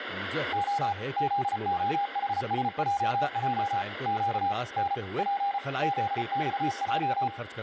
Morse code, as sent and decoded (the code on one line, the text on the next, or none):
--- / --.. --- .... ... .--- .--- / --.- / -. / .--. / --.. -..- .---
O ZOHSJJ Q N P ZXJ